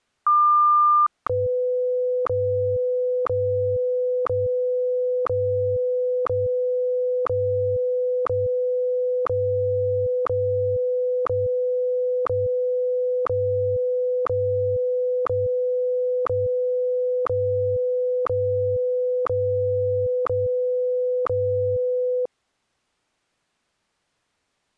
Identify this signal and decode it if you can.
Radio time signal (WWVH, Hawaii), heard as ticks, one a second.